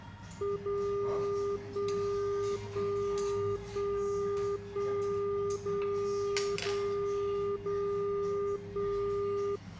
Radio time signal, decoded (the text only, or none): 0 1 1 1 1 0 0 0 1